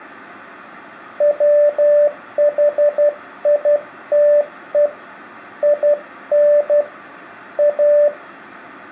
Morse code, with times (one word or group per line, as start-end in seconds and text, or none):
1.2-4.9 WHITE
5.6-6.8 IN
7.6-8.1 A